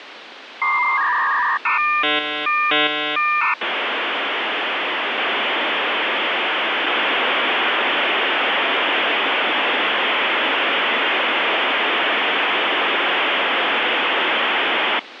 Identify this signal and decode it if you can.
Dial-up modem handshake (V.34 or later), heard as a whistle, warbles, then hiss, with phone line noise.